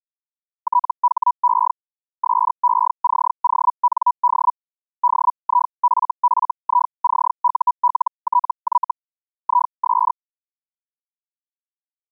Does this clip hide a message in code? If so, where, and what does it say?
Yes: Hellschreiber (Feld-Hell, 122.5 baud) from 0.6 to 10.1 s, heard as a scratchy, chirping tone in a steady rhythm, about 980 Hz. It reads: THE SECOND DIFFICULTY IS